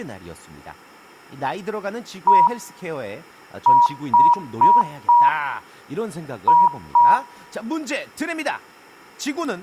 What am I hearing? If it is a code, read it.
Beep code, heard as beeps, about 960 Hz, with room echo and speech in Korean. 1-4-2. In Phoenix BIOS tables: parity failure in the first 64 KB of memory.